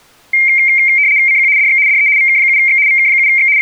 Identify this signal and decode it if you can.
RTTY (75 baud, 170 Hz shift), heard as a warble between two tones, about 2200 Hz centre. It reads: CQ DX DE VK7X VK7X …